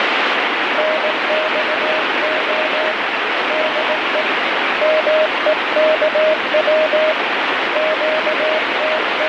Morse code, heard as a keyed tone, hand-sent with a paddle, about 18 wpm, 620 Hz, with heavy radio static. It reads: NXO DE MEKW …